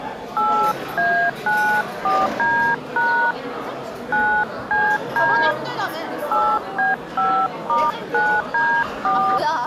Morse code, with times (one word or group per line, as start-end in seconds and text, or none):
none